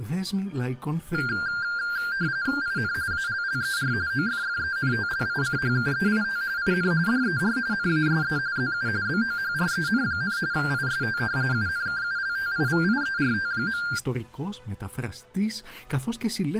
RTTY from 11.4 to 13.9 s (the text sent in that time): UNKULTIVIERT.